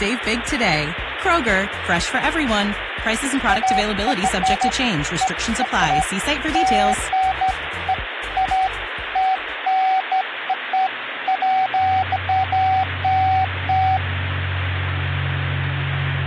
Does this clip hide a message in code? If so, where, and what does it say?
No, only beeps of irregular length, with phone line noise.